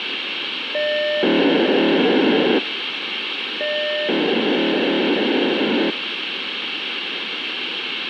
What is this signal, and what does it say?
POCSAG pager data (1200 baud), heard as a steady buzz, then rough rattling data, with radio hiss.